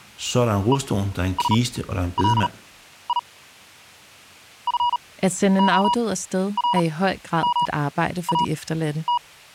Morse code (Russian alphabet), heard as a keyed tone, machine-sent, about 38 wpm, spaced as for 12 wpm, 960 Hz, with speech in Danish. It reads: ЕСЛИ ФОРМАТ